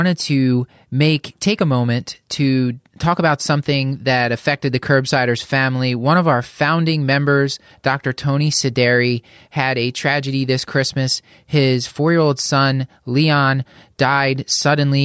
Speech in English. There is no code.